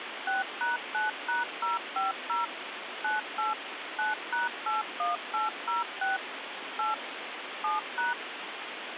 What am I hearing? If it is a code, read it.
DTMF, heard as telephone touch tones, dialled by machine, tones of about 160 ms, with phone line noise. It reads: 6#9#050 98 9#81806 8 7#